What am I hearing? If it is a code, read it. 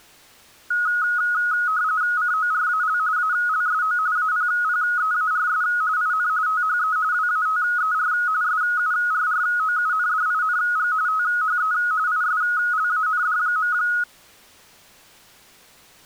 RTTY (45.45 baud, 170 Hz shift), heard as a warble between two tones, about 1360 Hz centre. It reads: CORAL ALSO APPEARS IN THE WATER SURROUNDING THE ISLAND.